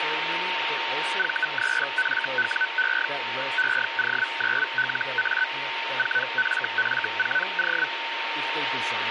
Hellschreiber (Feld-Hell, 122.5 baud), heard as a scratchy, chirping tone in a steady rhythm, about 1500 Hz, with radio static, a steady whistle near 920 Hz and speech in English. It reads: V3FWE EO9LA 4FF4O